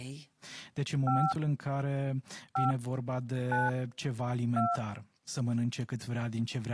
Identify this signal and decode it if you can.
DTMF, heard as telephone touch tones, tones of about 180 ms, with speech in Romanian. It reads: 5 5 9 2